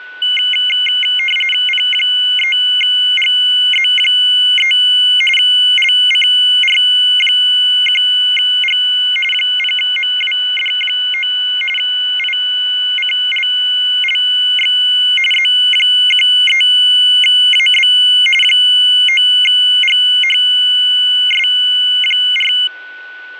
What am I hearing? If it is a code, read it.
RTTY (45.45 baud, 850 Hz shift), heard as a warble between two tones, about 2550 Hz centre, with a steady whistle near 1490 Hz. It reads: P3GZ3 LCR1G 0MWD9 ICLLX Z13AB 9GHS4